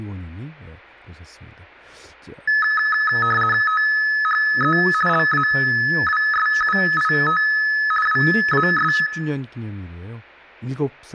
RTTY (50 baud, 450 Hz shift), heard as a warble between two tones, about 1500 Hz centre, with room echo and speech in Korean. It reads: THE LAWSUIT WAS